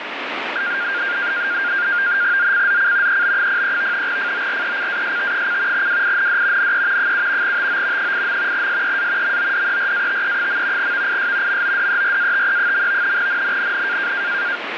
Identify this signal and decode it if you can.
NAVTEX (SITOR-B), 100 baud, 170 Hz shift, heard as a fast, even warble, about 1500 Hz centre, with radio static. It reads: ZCZC EB03 FORECAST: WIND NE 7 TO 8. SEA MODERATE. VIS MODERATE. NNNN